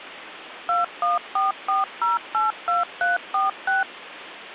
DTMF, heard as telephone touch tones, dialled by machine, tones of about 160 ms, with phone line noise. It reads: 2144082346